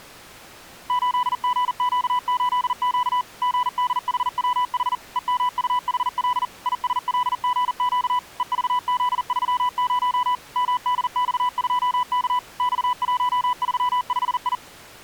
Morse code, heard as a keyed tone, machine-sent, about 40 wpm, 990 Hz. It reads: 8GQ8Q GDHWH EMUHL ISLGQ EVZ30 MDX2K X135I